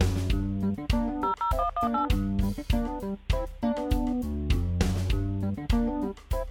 DTMF, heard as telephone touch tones, dialled by machine, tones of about 110 ms. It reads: 00118